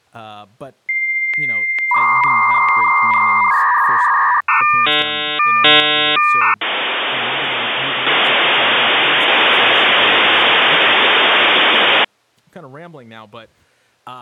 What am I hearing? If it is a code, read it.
Dial-up modem handshake (V.34 or later), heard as a whistle, warbles, then hiss, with speech in English.